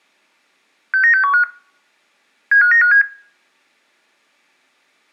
Five-tone selective call (CCIR), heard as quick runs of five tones, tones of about 100 ms, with room echo. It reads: 69615 75957